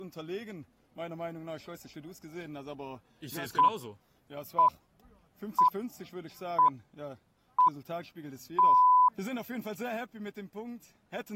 Radio time signal (six pips, as the Greenwich Time Signal), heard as pips.